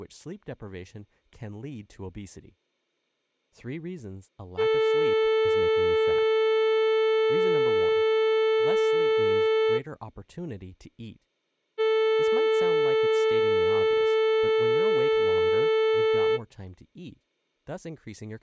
Ship horn signal, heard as a ship's horn, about 440 Hz, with speech in English. 2 long. At sea: a vessel under power that has stopped in fog.